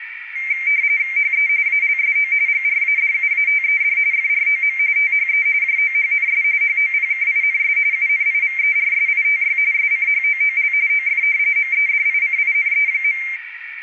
RTTY (45.45 baud, 170 Hz shift), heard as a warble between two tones, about 2200 Hz centre, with radio static and a narrow filter. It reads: HE ALSO GRADUATED FROM THE JOHNS HOPKINS UNIVERSITY SCHOOL OF MEDICINE.